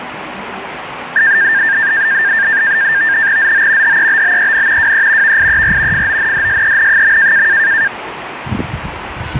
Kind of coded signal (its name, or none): NAVTEX (SITOR-B)